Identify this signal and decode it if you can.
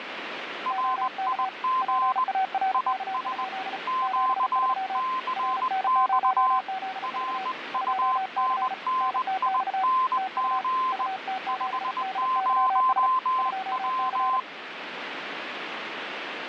Morse code, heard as two keyed tones, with radio static. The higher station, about 20 wpm, 1040 Hz: RIG IS QCX RUNNING 50W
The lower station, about 35 wpm, 760 Hz: OK PARK? 73 RN0ZV 2C NTX TU UT7DYS 2C